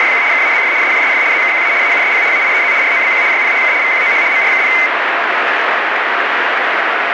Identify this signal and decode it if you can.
RTTY (75 baud, 170 Hz shift), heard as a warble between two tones, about 2150 Hz centre, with radio static. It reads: … KAZF SJSF ZKQA AUSP AIEZ ROBQ YPHK VQOH MRKP